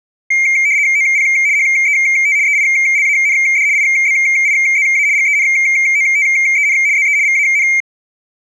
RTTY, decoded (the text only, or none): OP HET EILAND IBIZA GENOTEN ZE VAN